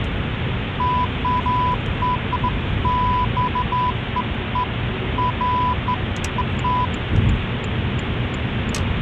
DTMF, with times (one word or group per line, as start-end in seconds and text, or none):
none